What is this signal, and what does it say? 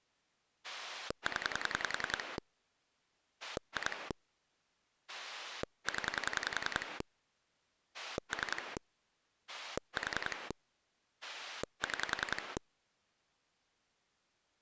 Pulse dialling, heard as a rotary dial, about 10 pulses a second. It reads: 0 2 0 3 4 6